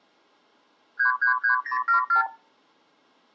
Multi-frequency trunk signalling (R2, with the far end's replies), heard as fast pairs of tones, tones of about 110 ms. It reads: 333074